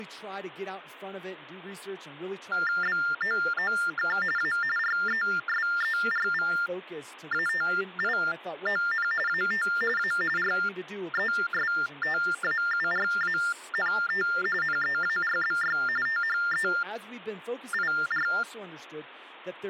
TTY/TDD text telephone tones (45.45 baud Baudot), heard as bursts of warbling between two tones, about 400 Hz shift, 1600 Hz centre, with speech in English. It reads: BOOK A RESERVATION AT A RESTAURANT NEARBY THEIR